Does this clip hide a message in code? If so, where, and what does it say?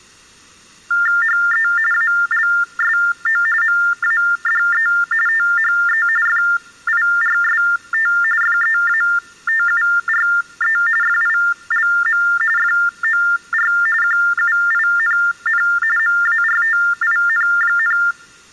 Yes: TTY/TDD text telephone tones (45.45 baud Baudot) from 0.9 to 18.1 s, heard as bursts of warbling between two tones, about 400 Hz shift, 1600 Hz centre. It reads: HE ALSO MADE THE FIRST FEATURE FILM FOR QUINN MARTIN,